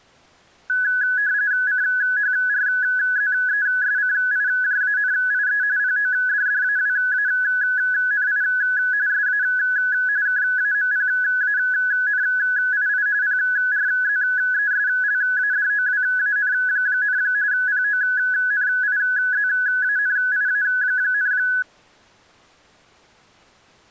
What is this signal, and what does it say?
RTTY (45.45 baud, 170 Hz shift), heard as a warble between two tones, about 1600 Hz centre. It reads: CHRZESCIJANIE PODDAWANI SA KAMPANII PRZESLADOWAN, PONIZANIA,